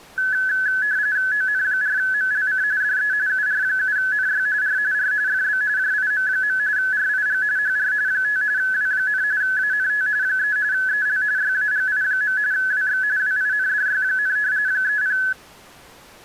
RTTY (45.45 baud, 170 Hz shift), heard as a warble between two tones, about 1600 Hz centre. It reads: ON4MLC DE UR7NY R R FB JIM. RIG HR 5 W, ANT 3 EL YAGI. WX WINDY, 30